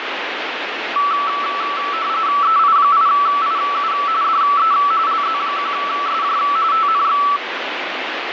RTTY (45.45 baud, 170 Hz shift), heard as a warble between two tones, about 1230 Hz centre, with radio static. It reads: EI8IU DE LZ1SJ TNX